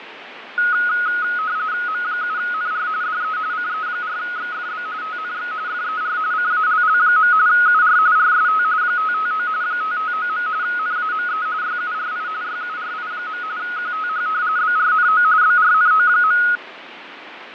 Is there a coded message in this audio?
Yes: RTTY (45.45 baud, 170 Hz shift) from 0.6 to 16.6 s, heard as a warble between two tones, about 1360 Hz centre, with radio static and fading. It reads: M7NR DE CE4XFB TNX FER CALL. UR RST 559 559. NAME YURI YURI. QTH BRNO BRNO.